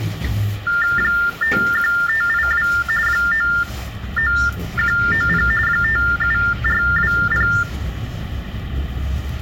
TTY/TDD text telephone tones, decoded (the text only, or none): 51582 99190 57420